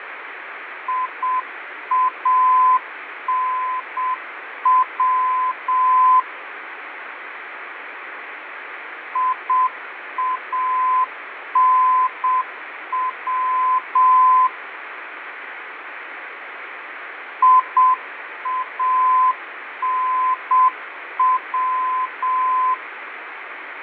Morse code, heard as a keyed tone, machine-sent, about 7 wpm, 1020 Hz, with radio static and fading. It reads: IANW IANW IANW